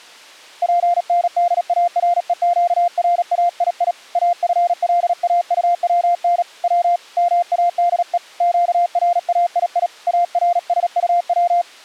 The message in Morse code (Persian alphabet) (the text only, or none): پندارهگرایی افلاطون و ماده گرایی ارسطو